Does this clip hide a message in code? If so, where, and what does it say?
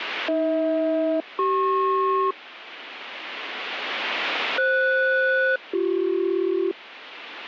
Yes: aircraft SELCAL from 0.3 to 6.7 s, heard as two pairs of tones. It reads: AH-CP FS-BC